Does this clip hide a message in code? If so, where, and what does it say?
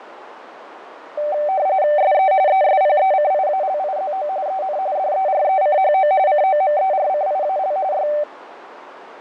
Yes: RTTY (45.45 baud, 170 Hz shift) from 1.2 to 8.2 s, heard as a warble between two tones, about 680 Hz centre, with radio static, fading and a narrow filter. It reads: SE ESPECIALIZO EN DERECHO COMERCIAL Y